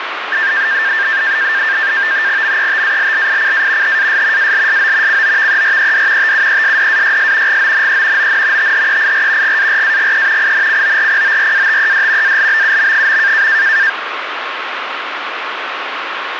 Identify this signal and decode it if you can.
NAVTEX (SITOR-B), 100 baud, 170 Hz shift, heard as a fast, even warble, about 1700 Hz centre, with radio static. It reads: METALLICA HAS ALSO COVERED TUESDAYS GONE ON THEIR GARAGE INCORPORATED ALBUM.